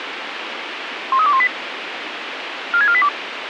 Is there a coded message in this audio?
Yes: five-tone selective call (ZVEI) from 1.1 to 3.1 s, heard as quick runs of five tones, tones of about 70 ms, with radio hiss. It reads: 13218 46482